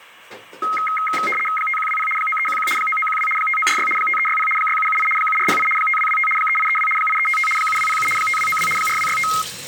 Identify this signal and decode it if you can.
RTTY (75 baud, 850 Hz shift), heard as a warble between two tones, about 1700 Hz centre, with kitchen noise. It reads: 5120 9311 9912 5946 5360 6778 7408 5225 3832 8355 7207 5292 4265